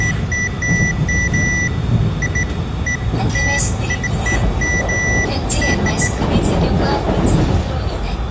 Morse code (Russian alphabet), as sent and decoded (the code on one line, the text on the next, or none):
none